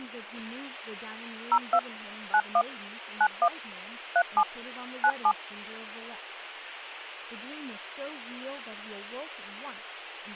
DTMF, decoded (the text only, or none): 02 91 91 37 97